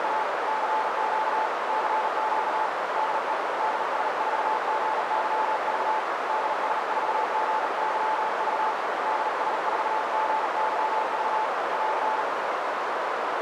Morse code, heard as a keyed tone, hand-sent with a bug key, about 39 wpm, 870 Hz, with heavy radio static and a narrow filter. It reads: … CQ CQ DE DS4GYV DS4GYV DS4GYV <AR>